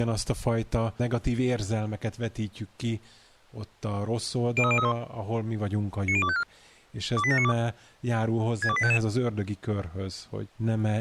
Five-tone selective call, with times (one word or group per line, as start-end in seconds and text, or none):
4.6-4.9 03031
6.1-6.4 90254
7.2-7.5 28792
8.6-9.0 62855